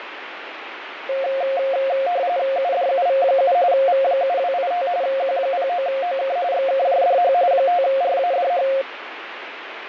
RTTY (45.45 baud, 170 Hz shift), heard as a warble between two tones, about 620 Hz centre, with radio static. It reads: UDUV7 V7285 Q09OK XKJDH 5RADH